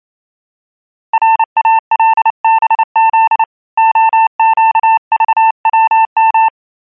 Morse code, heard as a keyed tone, hand-sent with a paddle, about 29 wpm, 890 Hz. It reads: RALBZ OQVWM